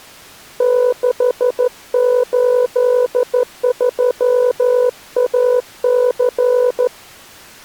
Morse code, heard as a keyed tone, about 14 wpm, 500 Hz. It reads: 683AC